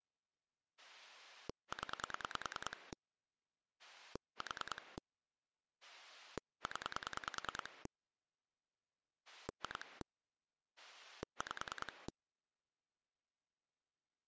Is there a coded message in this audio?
Yes: pulse dialling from 0.8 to 12.1 s, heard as a rotary dial, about 10 pulses a second. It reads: 0 4 0 2 5